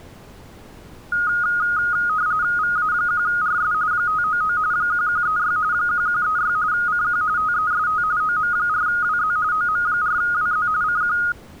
RTTY (45.45 baud, 170 Hz shift), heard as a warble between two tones, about 1340 Hz centre. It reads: VA1RS 599 1136 1136 CQ TEST OM4WZ OM4WZ CQ